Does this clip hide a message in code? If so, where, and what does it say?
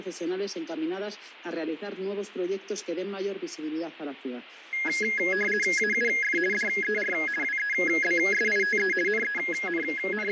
Yes: RTTY (50 baud, 450 Hz shift) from 4.7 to 10.3 s, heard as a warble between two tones, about 1900 Hz centre, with radio static and fading. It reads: AUF DER WEBSITE …